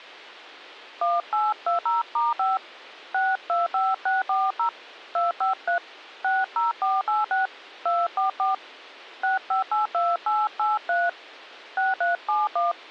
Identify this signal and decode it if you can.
DTMF, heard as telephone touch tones, dialled by hand, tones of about 150 ms. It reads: 1820*5 625640 253 60486 244 6582883 6371